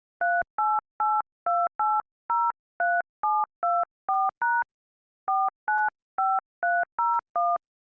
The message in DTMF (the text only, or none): 3882803724# 495301